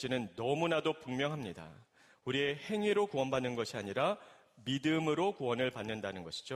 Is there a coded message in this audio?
No.